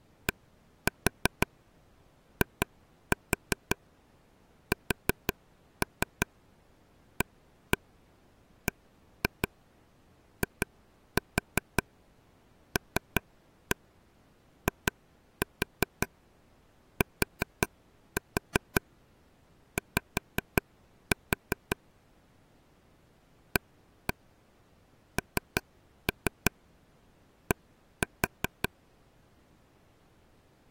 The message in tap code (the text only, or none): DISABILITY AND